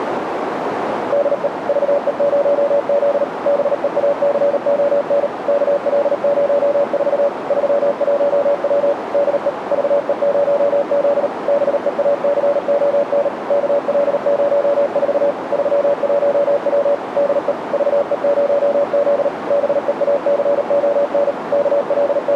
Morse code, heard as a keyed tone, machine-sent, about 38 wpm, 570 Hz, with radio static and a narrow filter. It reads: DE VE0Z BEACON KL04 31W DE VE0Z BEACON KL04 31W DE VE0Z BEACON …